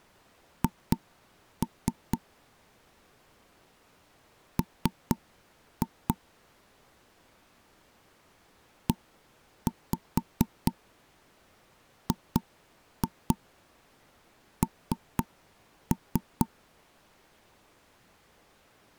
Tap code, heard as knocks on wood, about 4 knocks a second. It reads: H M EGN